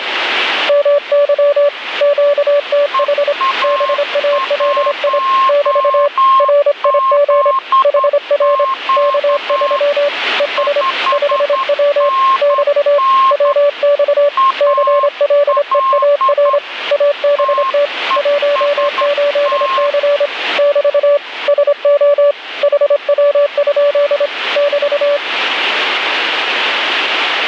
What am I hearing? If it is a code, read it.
Morse code, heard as two keyed tones, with radio static. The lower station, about 26 wpm, 580 Hz: MY QTH BALI <BT> RIG HR K3 ES 5W <BT> WX CLEAR ABT 18C <BT> SO HW? <BT>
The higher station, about 10 wpm, 1070 Hz: EA1ZQ 5NN AL TEST